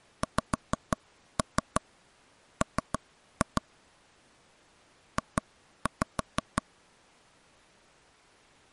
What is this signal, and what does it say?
Tap code, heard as taps on a table, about 6 knocks a second. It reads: XM J